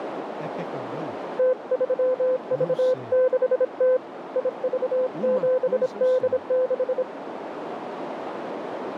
Morse code, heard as a keyed tone, hand-sent with a bug key, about 26 wpm, 510 Hz, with radio static, a narrow filter and speech in Portuguese. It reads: T3V6T IV7D6